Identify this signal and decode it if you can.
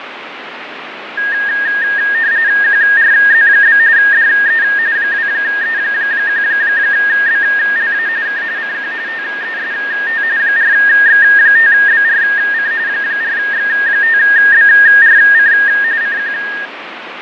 RTTY (45.45 baud, 170 Hz shift), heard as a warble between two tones, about 1750 Hz centre, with radio static and fading. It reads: QRZ? DE 2E1BLA K CQ TEST 4X5BRC 4X5BRC CQ